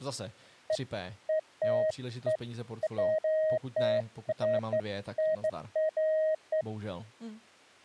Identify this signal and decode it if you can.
Beeps of irregular length, with speech in Czech. There is no code.